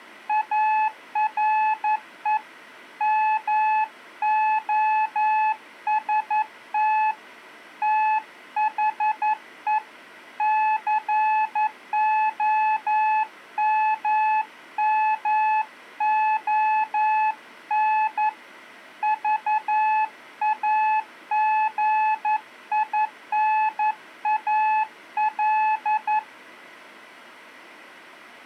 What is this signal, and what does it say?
Morse code, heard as a keyed tone, hand-sent with a paddle, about 11 wpm, 860 Hz. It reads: ARE MOST THE COMMON VAGINAL